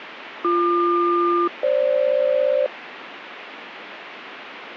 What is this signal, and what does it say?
Aircraft SELCAL, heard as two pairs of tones, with radio static. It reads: BQ-FG